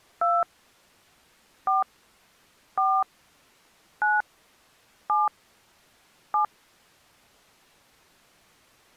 DTMF, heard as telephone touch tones, dialled by hand, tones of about 180 ms. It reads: 2 4 4 9 7 7